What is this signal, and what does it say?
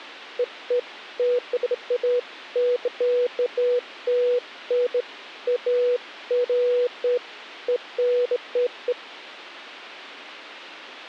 Beeps of irregular length. There is no code.